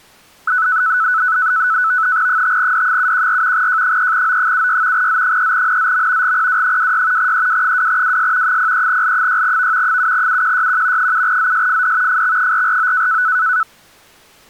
NAVTEX (SITOR-B), 100 baud, 170 Hz shift, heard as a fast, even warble, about 1400 Hz centre. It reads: 5D714 J3O76 Z3NZM GPW26 EW2WS 03L6V 7UQYQ 7ZSFD FX449